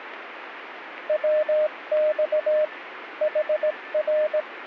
Morse code, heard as a keyed tone, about 17 wpm, 610 Hz, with radio static and a weaker station near 1770 Hz. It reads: WX HR